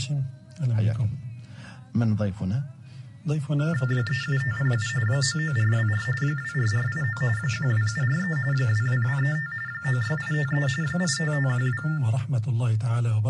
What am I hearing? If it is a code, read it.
TTY/TDD text telephone tones (45.45 baud Baudot), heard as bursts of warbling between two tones, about 400 Hz shift, 1600 Hz centre, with room echo. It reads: 37507 99424 24489 12743 22235 96853 85512